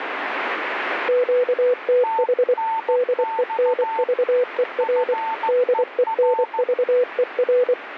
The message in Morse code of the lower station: QTH DENVER DENVER

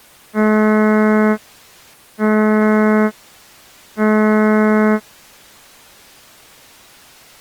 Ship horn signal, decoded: 3 short

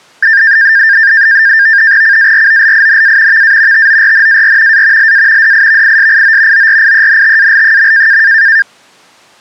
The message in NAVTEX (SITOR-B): CAROLINA VA TORNAR A LA DIVISIO ORIENTAL.

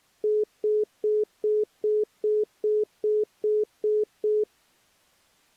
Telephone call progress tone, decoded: congestion tone

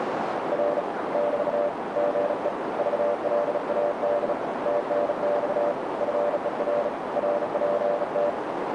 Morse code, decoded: R <BT> GE VLAD TNX FER RPT

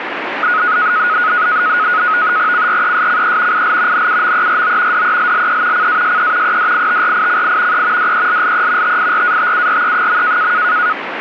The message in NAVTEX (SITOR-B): CRESCE IL NUMERO DELLE CASE EDITRICI E DELLE TIRATURE.

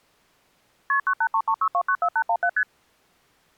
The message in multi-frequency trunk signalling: KP 98336294817 ST

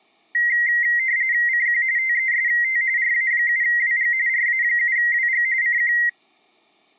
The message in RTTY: CQ TEST RA7WG RA7WG CQ

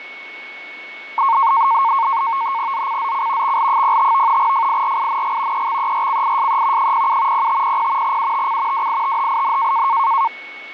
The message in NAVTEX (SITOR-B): ZCZC XL05 FIRING EXERCISE 07 0500 UTC WITHIN

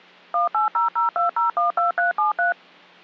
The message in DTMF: 18002012373

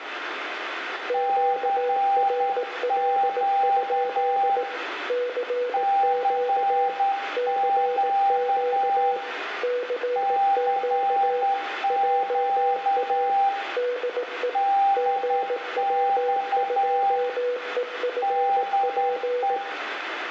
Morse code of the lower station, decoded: QRL? CQ CQ CQ JA DE GW2EFP

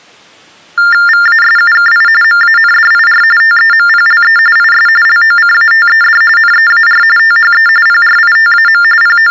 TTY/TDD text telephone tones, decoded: VASUKI MANDIR TEMPLE IS LOCATED NEAR THE PRITAM …

